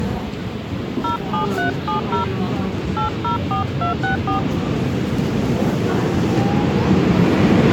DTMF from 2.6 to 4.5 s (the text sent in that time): 804264